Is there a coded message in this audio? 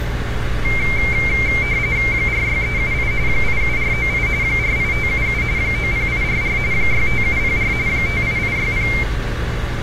Yes: RTTY (45.45 baud, 170 Hz shift) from 0.6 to 9.0 s, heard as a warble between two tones, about 2200 Hz centre, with radio static, a narrow filter and street noise. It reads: 46378 87498 48577 90844 65704 58860